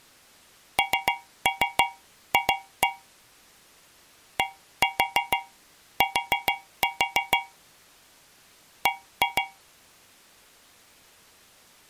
Tap code, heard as taps on a metal pipe, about 6 knocks a second. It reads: NF DT B